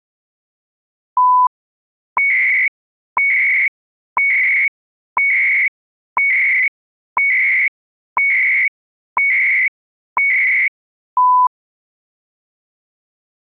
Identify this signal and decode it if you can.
Radio time signal (CHU, Canada), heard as beeps and data bursts, one a second.